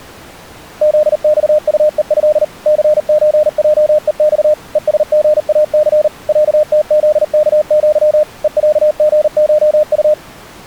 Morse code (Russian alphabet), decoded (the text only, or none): ЗЬУЕЭ ЦЧЙЕЬ ЕСГАЦ ЯТЗКЪ ЕЯГШУ